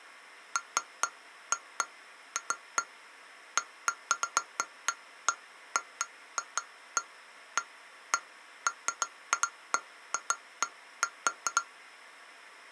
Irregular taps on glass. There is no code.